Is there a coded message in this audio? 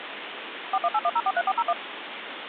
Yes: DTMF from 0.7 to 1.7 s, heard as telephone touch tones, dialled by machine, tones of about 50 ms, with phone line noise. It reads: 4181043401